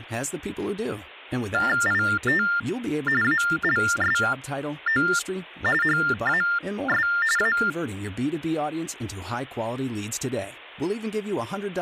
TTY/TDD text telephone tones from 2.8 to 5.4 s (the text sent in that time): ALSO